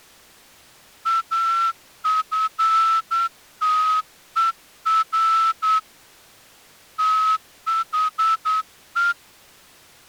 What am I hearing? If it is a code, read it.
Morse code, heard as a whistle, hand-sent with a straight key, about 9 wpm. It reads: AFTER THE